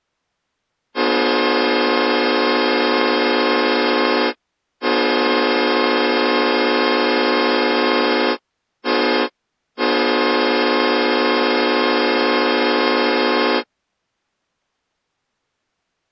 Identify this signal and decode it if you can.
Train horn signal, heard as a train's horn. 2 long, 1 short, 1 long. On North American railways: approaching a public crossing.